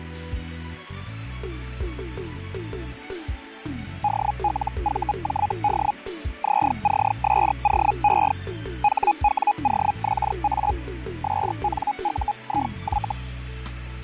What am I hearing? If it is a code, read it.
Hellschreiber (Feld-Hell, 122.5 baud), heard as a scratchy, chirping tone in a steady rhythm, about 830 Hz, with fading. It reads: DLVJD ZCSOE HWOXA SNUIY